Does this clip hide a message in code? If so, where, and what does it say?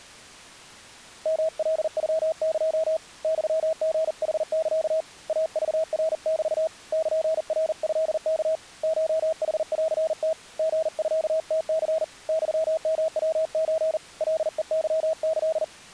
Yes: Morse code (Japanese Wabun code) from 1.2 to 15.7 s, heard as a keyed tone, hand-sent with a paddle, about 40 wpm, 640 Hz. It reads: ヨカノエ ユリヌサ イクナメ ルナトワ コヌンム リミムニ ユヨヤソ カヘケキ